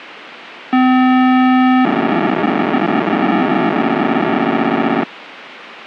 POCSAG pager data (512 baud), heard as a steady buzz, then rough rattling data, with radio hiss.